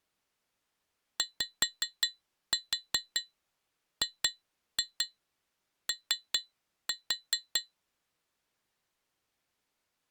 Tap code, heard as taps on glass, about 5 knocks a second. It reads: YGO